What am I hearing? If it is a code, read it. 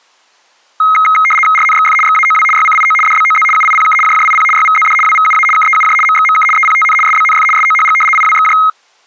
RTTY (75 baud, 850 Hz shift), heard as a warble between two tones, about 1700 Hz centre. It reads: RNXF XAOW YCIO DBOZ UIPK JJIP YVZD WVUA KEUJ MXMK EPTN SBNF SOHG IWXJ